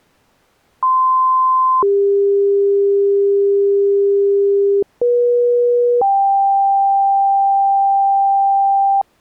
Two-tone page, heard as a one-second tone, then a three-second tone, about 1040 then 400 Hz, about 480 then 790 Hz.